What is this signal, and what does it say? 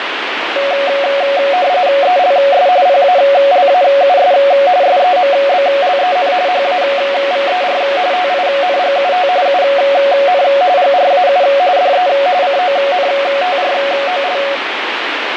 RTTY (45.45 baud, 170 Hz shift), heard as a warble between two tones, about 640 Hz centre, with radio static. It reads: ELS PALAUS SEMBLEN HAVER TINGUT UN GRAU DE CONTROL